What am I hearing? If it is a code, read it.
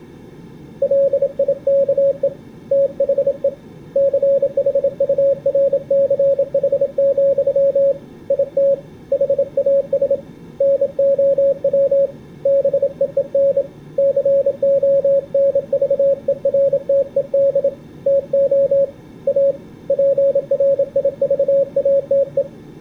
Morse code, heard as a keyed tone, hand-sent with a bug key, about 27 wpm, 550 Hz. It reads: LIKE THE CHURCH, IT HAS NOW BEEN CONVERTED TO A PRIVATE